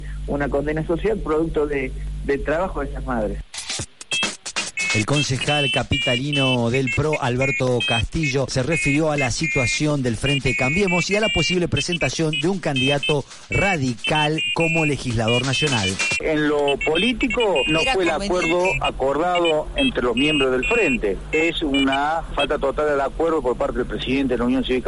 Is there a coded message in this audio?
No, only pairs of high tones at irregular times.